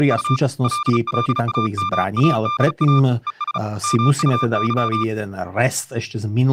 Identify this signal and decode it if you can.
Morse code, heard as a keyed tone, hand-sent with a paddle, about 35 wpm, 1190 Hz, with speech in Slovak. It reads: … LLAMADA ES MUY